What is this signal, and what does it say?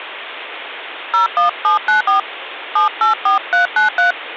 DTMF, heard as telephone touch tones, dialled by hand, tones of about 130 ms, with phone line noise. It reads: 01794 784393